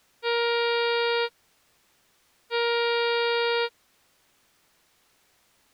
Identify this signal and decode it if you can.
Ship horn signal, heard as a ship's horn, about 470 Hz. 2 short. At sea: I am altering course to port.